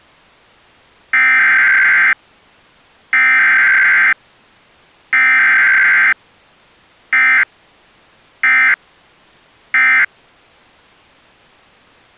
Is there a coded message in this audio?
Yes: Emergency Alert System (SAME) tones (header bursts, then end-of-message bursts) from 1.1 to 10.0 s, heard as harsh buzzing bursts, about 520.83 baud.